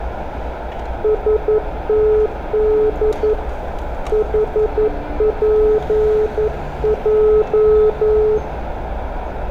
Morse code, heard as a keyed tone, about 11 wpm, 430 Hz, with radio static, a narrow filter and street noise. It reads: STD HPJ